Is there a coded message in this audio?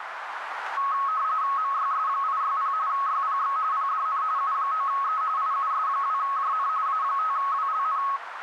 Yes: RTTY (45.45 baud, 170 Hz shift) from 0.8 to 8.2 s, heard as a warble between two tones, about 1190 Hz centre, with radio static and a narrow filter. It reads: MYS860 YPX PDN U9E IUS2JN A5WLN